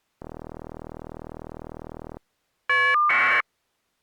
Caller ID data burst, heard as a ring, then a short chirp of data, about 1200 baud.